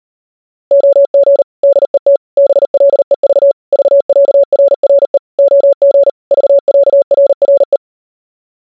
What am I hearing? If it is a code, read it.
Morse code (with Danish letters), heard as a keyed tone, machine-sent, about 39 wpm, 560 Hz. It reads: OG DET BLEV VÆRRE OG VÆRRE